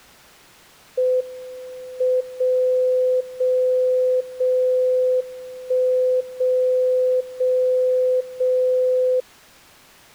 Radio time signal (WWVB), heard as a tone whose level steps once a second, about 510 Hz. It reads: M 0 0 0 1 0 0 0